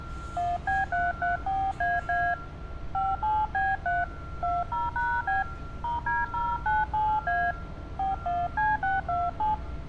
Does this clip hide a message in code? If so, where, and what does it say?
Yes: DTMF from 0.4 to 9.5 s, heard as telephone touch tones, dialled by hand, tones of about 200 ms, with street noise. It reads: 1B334AA 57B3 20#B *D097A 41C627